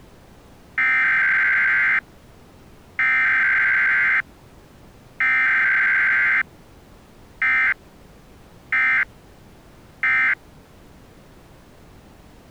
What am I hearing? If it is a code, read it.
Emergency Alert System (SAME) tones (header bursts, then end-of-message bursts), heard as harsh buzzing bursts, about 520.83 baud.